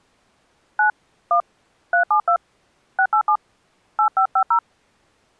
DTMF, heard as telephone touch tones, dialled by hand, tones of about 90 ms. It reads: 9 1 372 687 8550